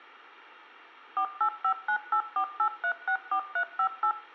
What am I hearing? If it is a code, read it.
DTMF, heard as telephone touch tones, dialled by machine, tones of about 80 ms, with room echo. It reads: 4859848364358